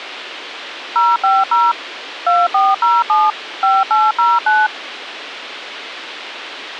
DTMF, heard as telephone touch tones, dialled by machine, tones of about 200 ms, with radio hiss and a squelch burst at the end. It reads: 050 2407 5809